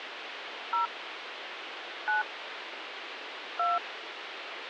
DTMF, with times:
0.7-0.9 0
2.1-2.2 9
3.6-3.8 2

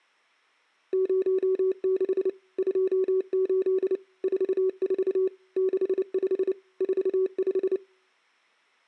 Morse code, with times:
0.9-2.3 06
2.6-4.0 28
4.2-5.3 44
5.6-6.5 65
6.8-7.8 45

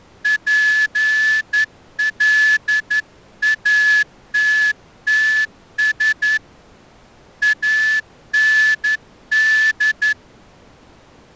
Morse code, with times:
0.3-6.4 PLATTS
7.4-10.1 AND

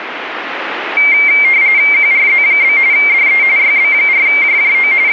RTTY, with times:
1.9-2.8 QRZ?
2.9-3.4 DE
3.6-4.9 YB4JJO
5.1-5.1 …

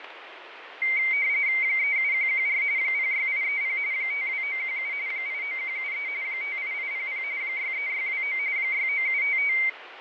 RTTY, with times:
1.6-2.6 37114
2.8-3.8 06830
3.9-4.9 52917
5.1-6.1 89173
6.2-7.2 58800
7.4-8.4 63629
8.6-9.5 69755

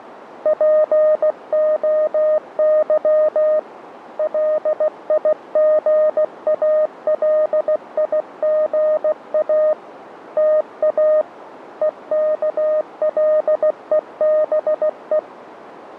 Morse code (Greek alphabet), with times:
0.5-3.6 ΠΟΥ
4.2-9.7 ΛΙΓΑΛΙΓΑ
10.4-11.2 ΤΑ
11.8-15.2 ΕΚΛΕΒΕ

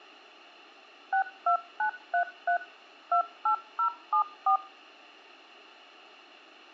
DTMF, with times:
1.1-2.6 62933
3.1-4.6 28074

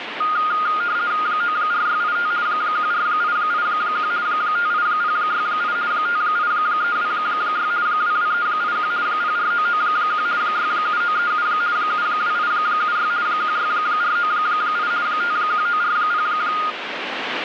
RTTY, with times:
1.3-2.3 94685
2.5-4.1 14881
4.3-5.8 58068
5.9-7.7 58326
7.9-8.9 22381
9.1-10.3 04991
10.4-11.5 67937
11.8-13.1 72876
13.3-14.9 16498
15.1-16.3 51940

